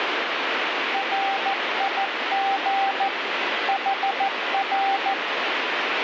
Morse code, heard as a keyed tone, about 14 wpm, 780 Hz, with heavy radio static. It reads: RIG HR